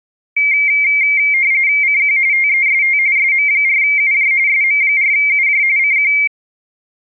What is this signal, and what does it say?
RTTY (45.45 baud, 170 Hz shift), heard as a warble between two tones, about 2200 Hz centre. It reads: CQ TEST SM4UJ SM4UJ CQ